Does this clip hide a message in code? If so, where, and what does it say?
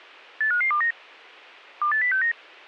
Yes: five-tone selective call (CCIR) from 0.4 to 2.3 s, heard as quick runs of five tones, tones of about 100 ms, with a squelch burst at the end. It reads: 85529 28069